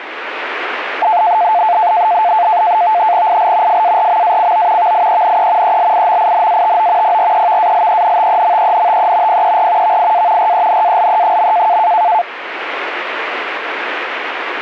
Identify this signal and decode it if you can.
NAVTEX (SITOR-B), 100 baud, 170 Hz shift, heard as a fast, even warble, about 790 Hz centre, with radio static. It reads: IL FARMACO VIENE ELIMINATO PREVALENTEMENTE PER VIA RENALE.